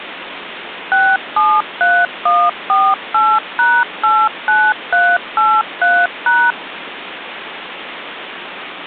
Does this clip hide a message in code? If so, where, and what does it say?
Yes: DTMF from 0.9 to 6.5 s, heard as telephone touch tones, dialled by machine, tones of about 240 ms, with phone line noise. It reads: 673148#89383#